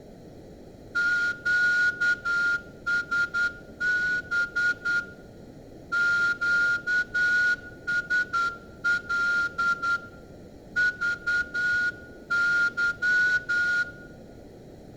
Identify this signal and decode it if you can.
Morse code, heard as a whistle, hand-sent with a straight key, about 10 wpm, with room echo. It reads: QSB QSL VY